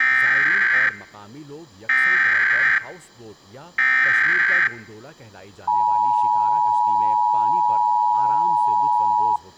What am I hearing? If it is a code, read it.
Emergency Alert System (SAME) tones (header bursts, then the 853 and 960 Hz attention tone), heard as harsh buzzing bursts, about 520.83 baud, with speech in Urdu.